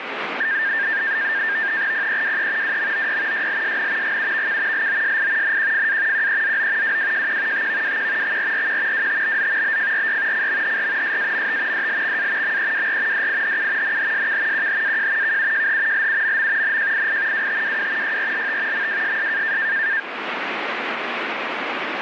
NAVTEX (SITOR-B), 100 baud, 170 Hz shift, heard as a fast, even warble, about 1700 Hz centre, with radio static. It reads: PEWE WMOY YLSN GUVK LOSI NQFA QEZO WWJQ TVWQ XRRQ WTBZ BFRY CMHR SAMT DLXA MEWR DIHU NHSK QHAJ KUJH LUMM NJII WTWW YRLT MWSS